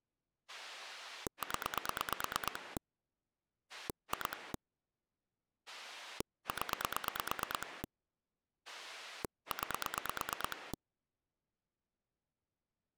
Pulse dialling, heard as a rotary dial, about 9 pulses a second. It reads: 0 2 0 9